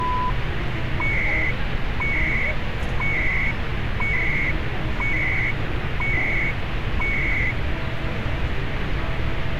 Radio time signal (CHU, Canada), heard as beeps and data bursts, one a second, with radio static and street noise.